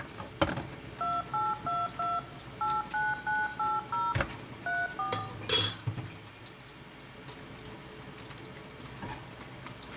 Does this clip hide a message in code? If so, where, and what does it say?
Yes: DTMF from 1.0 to 5.2 s, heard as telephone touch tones, dialled by machine, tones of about 200 ms, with a squelch burst at the end, room echo and kitchen noise. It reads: 2822 89980 34